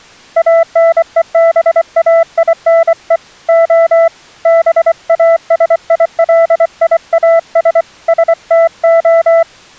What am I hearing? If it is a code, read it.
Morse code (Greek alphabet), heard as a keyed tone, hand-sent with a paddle, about 24 wpm, 660 Hz. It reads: ΑΝΕΒΑΙΝΕ Ο ΒΑΣΙΛΙΑΣ ΣΤΟ